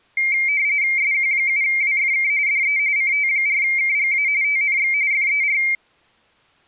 RTTY (45.45 baud, 170 Hz shift), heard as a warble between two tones, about 2200 Hz centre. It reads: SQ7WFK DE CT4KGA TNX FER